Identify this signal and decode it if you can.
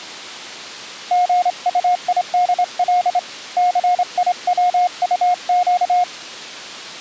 Morse code (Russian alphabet), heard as a keyed tone, hand-sent with a straight key, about 27 wpm, 720 Hz. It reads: ГУИДЛ ЦИВУЩ